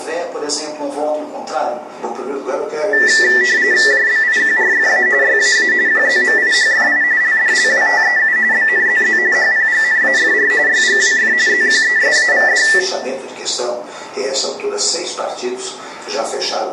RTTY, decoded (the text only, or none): JBIQRFA YAA QZMIHFI LDLWTEU BNZZ HPGNAFR YGWF ZQESAVD